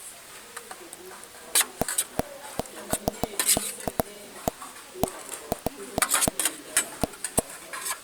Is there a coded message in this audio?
No, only irregular taps on a table, with kitchen noise.